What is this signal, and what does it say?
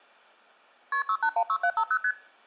Multi-frequency trunk signalling (R1, as on North American trunks), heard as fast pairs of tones, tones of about 70 ms. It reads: KP 6816750 ST